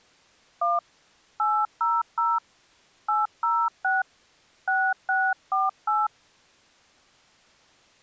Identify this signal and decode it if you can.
DTMF, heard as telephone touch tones, dialled by hand, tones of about 200 ms. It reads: 1 800 806 6648